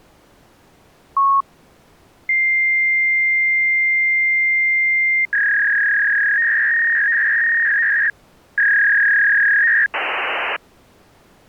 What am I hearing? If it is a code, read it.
Fax machine handshake, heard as a long tone, a warble and hiss.